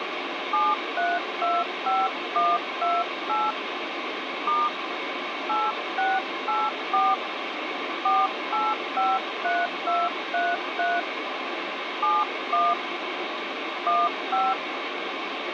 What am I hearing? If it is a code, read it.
DTMF, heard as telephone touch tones, dialled by hand, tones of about 210 ms, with phone line noise. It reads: 7325128 * 8684 4853233 71 15